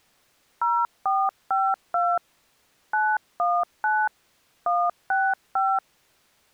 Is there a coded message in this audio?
Yes: DTMF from 0.6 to 5.8 s, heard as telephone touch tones, dialled by hand, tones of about 240 ms. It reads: 0452 919 165